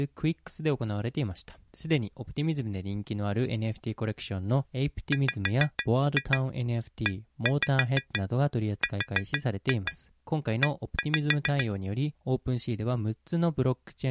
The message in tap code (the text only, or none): WERE